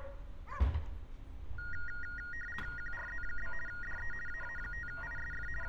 RTTY (50 baud, 450 Hz shift), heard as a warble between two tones, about 1650 Hz centre, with street noise. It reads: QRZ? DE AA5ISF …